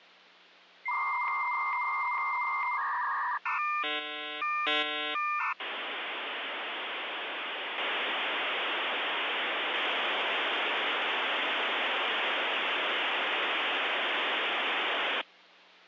Dial-up modem handshake (V.34 or later), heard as a whistle, warbles, then hiss.